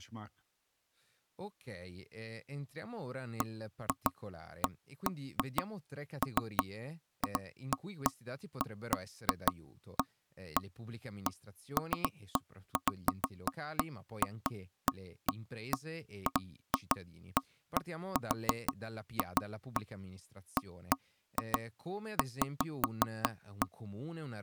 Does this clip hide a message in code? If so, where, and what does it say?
No, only irregular knocks on wood, with speech in Italian.